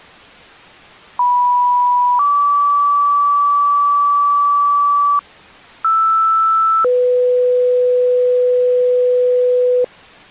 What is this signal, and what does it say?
Two-tone page, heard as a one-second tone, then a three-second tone, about 980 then 1150 Hz, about 1320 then 500 Hz.